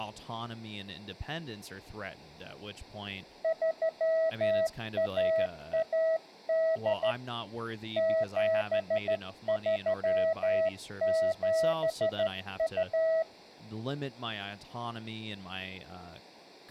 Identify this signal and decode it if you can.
Morse code (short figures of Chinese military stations), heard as a keyed tone, hand-sent with a straight key, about 13 wpm, 650 Hz, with room echo and speech in English. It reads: 3118 7372